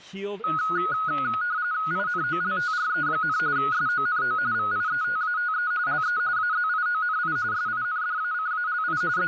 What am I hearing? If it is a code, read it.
RTTY (45.45 baud, 170 Hz shift), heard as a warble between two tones, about 1360 Hz centre, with static crashes and speech in English. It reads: INOLTRE, SONO VIETATE LE AZIONI SINDACALI …